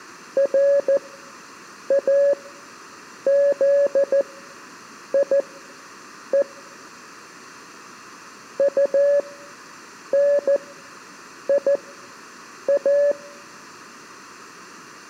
Morse code, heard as a keyed tone, machine-sent, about 14 wpm, spaced as for 7 wpm, 570 Hz. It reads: RAZIE UNIA